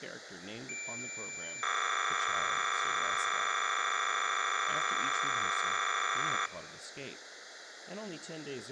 Cassette data (Kansas City type), 300 baud, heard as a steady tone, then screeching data.